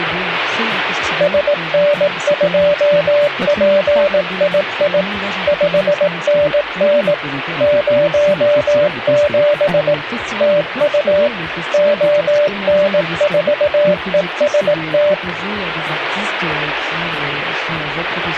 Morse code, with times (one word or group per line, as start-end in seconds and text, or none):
1.2-5.0 SN2PII
5.5-7.1 5NN
7.6-9.9 07
10.4-11.3 TU
11.7-15.1 ON4EST